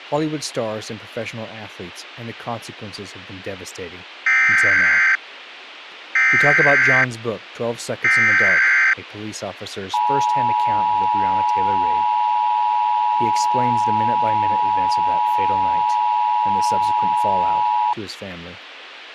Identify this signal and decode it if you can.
Emergency Alert System (SAME) tones (header bursts, then the 853 and 960 Hz attention tone), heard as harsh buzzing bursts, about 520.83 baud, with radio hiss and speech in English.